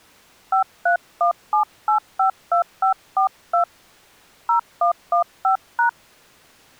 DTMF, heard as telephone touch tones, dialled by hand, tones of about 110 ms. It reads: 5317852542 0115#